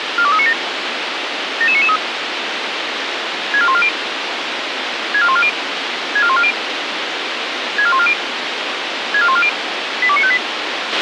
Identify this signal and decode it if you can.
Five-tone selective call (ZVEI), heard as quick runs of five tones, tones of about 70 ms, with radio hiss and a squelch burst at the end. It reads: 42397 77993 64140 64140 64140 64140 64140 82958